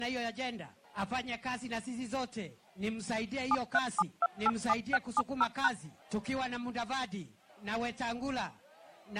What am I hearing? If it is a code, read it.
DTMF, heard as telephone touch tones, dialled by machine, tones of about 40 ms. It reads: 737287670#